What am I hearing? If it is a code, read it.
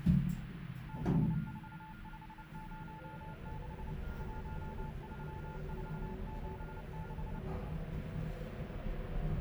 Morse code, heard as a keyed tone, machine-sent, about 29 wpm, 870 Hz, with radio static, a weaker station near 1410 Hz and the noise inside a lift. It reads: 64506 13476